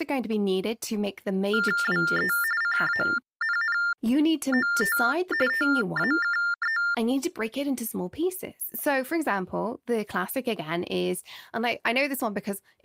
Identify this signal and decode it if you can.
TTY/TDD text telephone tones (45.45 baud Baudot), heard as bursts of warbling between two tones, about 400 Hz shift, 1600 Hz centre, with speech in English. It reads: WE CANNOT TAKE